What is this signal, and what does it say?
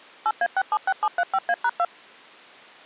DTMF, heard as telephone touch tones, dialled by machine, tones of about 50 ms. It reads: 8A676735A#2